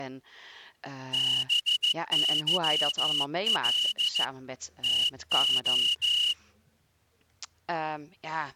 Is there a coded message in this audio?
Yes: Morse code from 1.1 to 6.4 s, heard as a whistle, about 14 wpm, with speech in Dutch. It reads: BYL TO